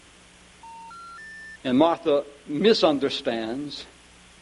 Telephone call progress tone (North American plan), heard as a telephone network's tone, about 910, 1370, 1800 Hz, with phone line noise. Special information tone.